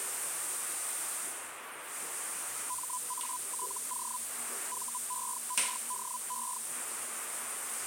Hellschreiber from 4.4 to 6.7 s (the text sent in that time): VERDE